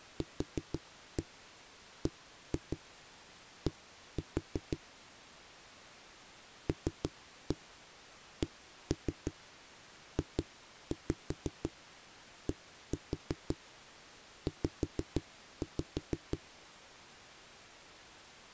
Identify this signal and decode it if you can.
Tap code, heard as knocks on a wall, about 5 knocks a second. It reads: QBD LCJDZ